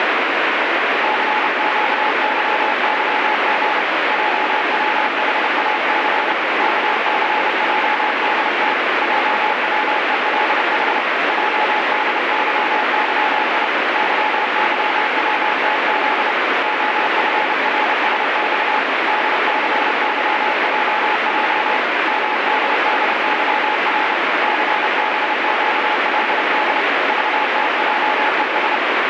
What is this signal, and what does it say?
Morse code, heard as a keyed tone, hand-sent with a paddle, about 30 wpm, 850 Hz, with heavy radio static. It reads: CQYYG JWHAC KCJDT JWELH JDYYI YYWTZ OFRSX DCYJJ MDDYR CBQLD VTJES